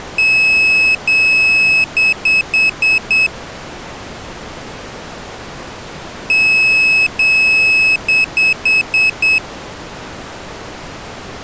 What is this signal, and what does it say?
Beep code, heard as a piezo beeper, played twice, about 2600 Hz. 2 long, 5 short.